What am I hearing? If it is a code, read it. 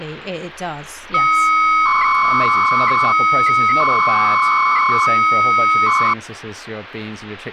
300-baud modem data (Bell 103 tones), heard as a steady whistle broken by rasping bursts, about 300 baud, 200 Hz shift, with speech in English.